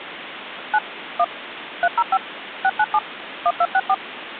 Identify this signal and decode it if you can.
DTMF, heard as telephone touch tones, dialled by machine, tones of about 50 ms, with phone line noise. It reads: 9 1 305 697 1264